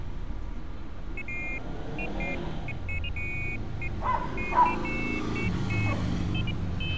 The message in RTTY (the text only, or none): none